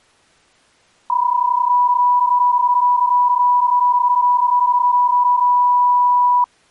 PSK31 (31.25 baud), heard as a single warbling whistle, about 980 Hz.